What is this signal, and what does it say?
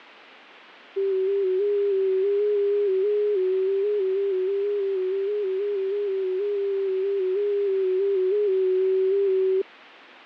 FT8 (one signal), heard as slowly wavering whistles, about 6.25 baud.